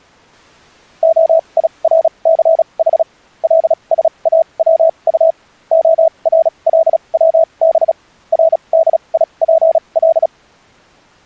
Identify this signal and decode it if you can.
Morse code (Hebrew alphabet), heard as a keyed tone, machine-sent, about 36 wpm, spaced as for 28 wpm, 650 Hz. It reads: הירסח לשאצט הרלצב רדיפל